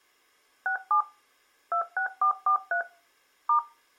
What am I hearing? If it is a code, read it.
DTMF, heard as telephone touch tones, dialled by machine, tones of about 100 ms. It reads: 67 26443 *